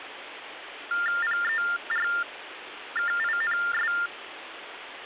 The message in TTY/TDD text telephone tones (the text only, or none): PERKINS